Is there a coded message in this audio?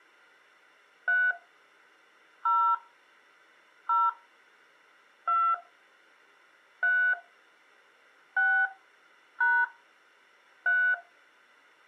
Yes: DTMF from 1.1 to 10.9 s, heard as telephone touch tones, dialled by hand, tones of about 250 ms. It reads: 3 0 0 2 3 6 # 3